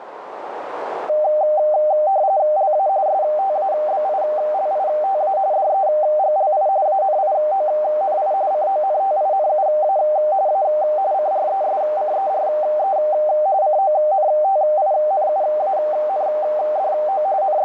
RTTY (45.45 baud, 170 Hz shift), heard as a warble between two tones, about 690 Hz centre, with radio static and a narrow filter. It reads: LA STABILITA DEGLI ANIONI CONTINUA A CRESCERE CONTINUANDO …